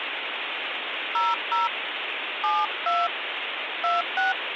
DTMF, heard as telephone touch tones, dialled by hand, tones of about 180 ms, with phone line noise. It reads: 00 72 26